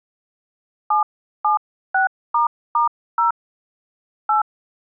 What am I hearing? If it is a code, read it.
DTMF, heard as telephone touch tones, dialled by hand, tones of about 130 ms. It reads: 776**0 8